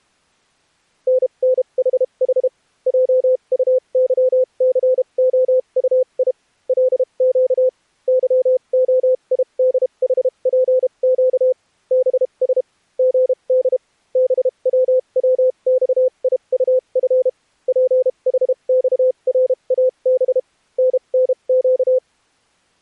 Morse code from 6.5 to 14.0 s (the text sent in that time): LQ YOIDHPQ BS GD